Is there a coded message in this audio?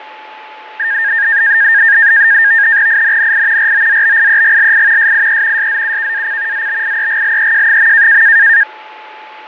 Yes: NAVTEX (SITOR-B), 100 baud, 170 Hz shift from 0.8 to 8.6 s, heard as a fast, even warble, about 1700 Hz centre, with radio static, fading and a steady whistle near 860 Hz. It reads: INNI ROZBIEGLI SIE SZUKAC ZBIEGLEJ.